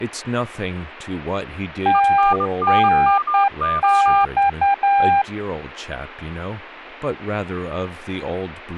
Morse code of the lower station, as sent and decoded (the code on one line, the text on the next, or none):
- -. -..-
TNX